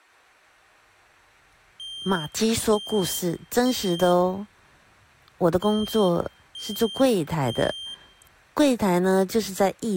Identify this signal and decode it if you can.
Alarm pattern, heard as an alarm's beeps, played twice, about 3150 Hz, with room echo and speech in Chinese. Temporal three. Smoke or fire, evacuate.